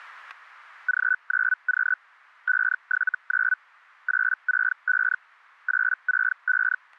Hellschreiber (Feld-Hell, 122.5 baud), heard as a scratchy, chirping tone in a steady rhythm, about 1500 Hz, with static crashes. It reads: G9Q 579 865 865